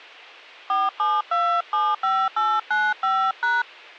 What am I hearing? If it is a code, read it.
DTMF, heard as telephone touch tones, dialled by hand, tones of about 240 ms. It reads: 47275895#